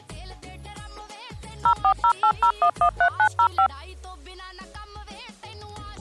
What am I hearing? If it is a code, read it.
DTMF, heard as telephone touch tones, dialled by machine, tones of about 80 ms. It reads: 04080113905